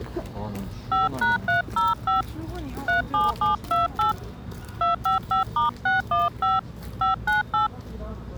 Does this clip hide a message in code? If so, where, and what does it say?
Yes: DTMF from 0.9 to 7.7 s, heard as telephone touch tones, dialled by hand, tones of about 140 ms, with the noise of a residential street. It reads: 5#305 37728 255*615 598